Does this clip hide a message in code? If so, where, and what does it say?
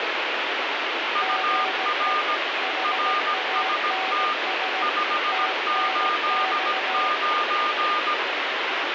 Yes: Morse code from 1.1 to 8.2 s, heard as two keyed tones, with heavy radio static. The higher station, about 17 wpm, 1210 Hz: UR RST 589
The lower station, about 17 wpm, 760 Hz: GE HANS TNX